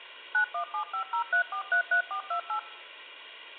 DTMF, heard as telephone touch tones, dialled by machine, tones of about 100 ms. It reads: 917503433428